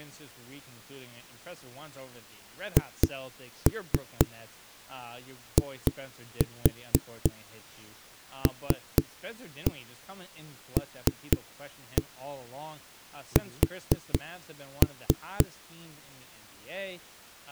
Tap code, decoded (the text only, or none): HILLS